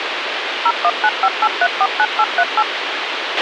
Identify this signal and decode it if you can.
DTMF, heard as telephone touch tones, dialled by machine, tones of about 50 ms, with radio hiss and a squelch burst at the end. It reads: 01958349838